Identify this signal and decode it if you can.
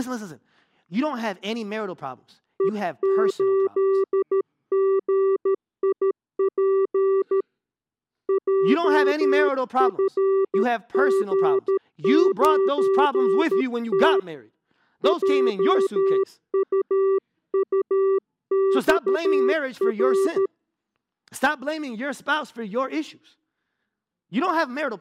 Morse code, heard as a keyed tone, hand-sent with a paddle, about 13 wpm, 390 Hz, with speech in English. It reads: E8GIP JFG9T JUUXR